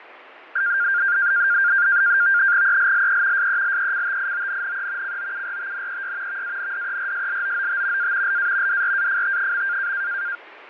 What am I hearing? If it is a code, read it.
NAVTEX (SITOR-B), 100 baud, 170 Hz shift, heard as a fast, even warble, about 1500 Hz centre, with radio static and fading. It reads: ELLE SELECTIONNE COURTNEY VANDERSLOOT A LA DRAFT.